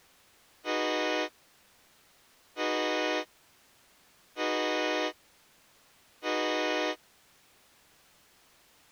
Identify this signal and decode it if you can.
Train horn signal, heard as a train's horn. 4 short. On North American railways: a request for a signal to be given or repeated.